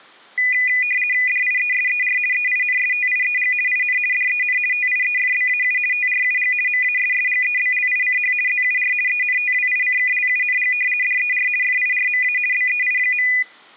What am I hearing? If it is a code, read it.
RTTY (50 baud, 450 Hz shift), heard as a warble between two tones, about 2250 Hz centre. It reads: DIESER EINSTIEG IN DEN TIEFBAU TRUG MASSGEBLICH ZUR ENTWICKLUNG DER FIRMA BEI.